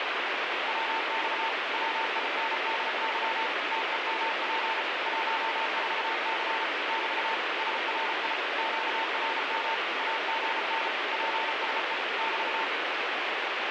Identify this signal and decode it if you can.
Morse code, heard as a keyed tone, machine-sent, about 34 wpm, 900 Hz, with heavy radio static. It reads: WX WINDY TEMP 14C <BT> SRI QRM AGN PSE <BT>